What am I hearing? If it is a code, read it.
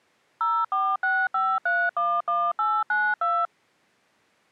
DTMF, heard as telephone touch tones, dialled by machine, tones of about 240 ms. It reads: 0465311892